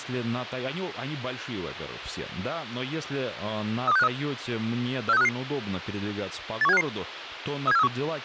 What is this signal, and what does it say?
Five-tone selective call (EEA), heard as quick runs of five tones, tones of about 40 ms, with speech in Russian. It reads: 32653 46355 81755 37431